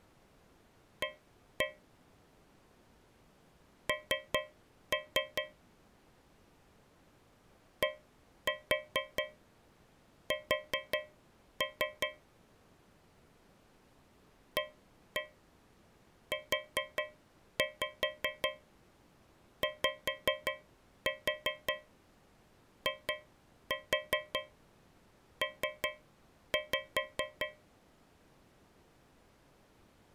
Tap code, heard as taps on a metal pipe, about 5 knocks a second. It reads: A N DS AUYIP